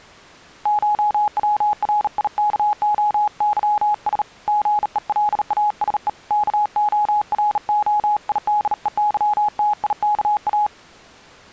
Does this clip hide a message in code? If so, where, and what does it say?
Yes: Morse code (Greek alphabet) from 0.6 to 10.7 s, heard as a keyed tone, hand-sent with a bug key, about 38 wpm, 840 Hz. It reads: ΧΩΡΙΚΟΥΣ ΓΕΛΑΣΕ ΚΟΡΟΙΔΕΥΤΙΚΑ